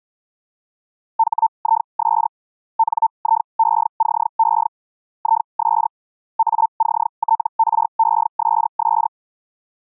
Hellschreiber (Feld-Hell, 122.5 baud), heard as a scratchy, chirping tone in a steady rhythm, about 900 Hz. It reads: HIS NIECE IS ACTRESS